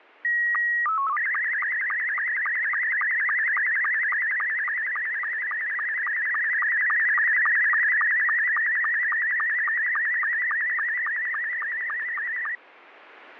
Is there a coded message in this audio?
Yes: SSTV (slow-scan television), Scottie S2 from 0.2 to 12.6 s, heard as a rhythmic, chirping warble, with static crashes.